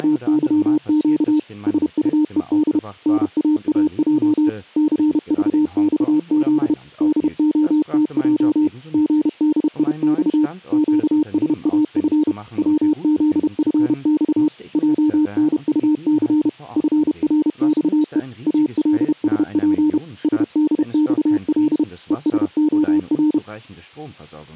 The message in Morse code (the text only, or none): … SUED NAAJ CVXZ DOTJ GDIX QSAF WZFX JNUC FRXE ALSP SDXL ESOR